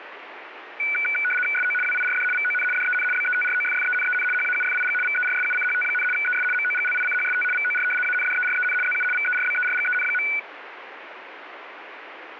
RTTY (75 baud, 850 Hz shift), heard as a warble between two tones, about 1900 Hz centre, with radio static. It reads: SO WIRD VON DEN BETROFFENEN HAUFIG VERSUCHT, ES MOGLICHST VOR ANDEREN ZU VERBERGEN.